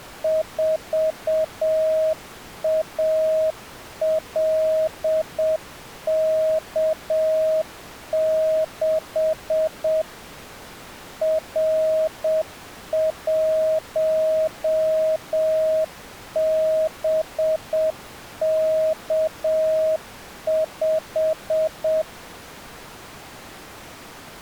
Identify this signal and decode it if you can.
Morse code, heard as a keyed tone, machine-sent, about 7 wpm, 630 Hz. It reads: 4ALK6 R1BK5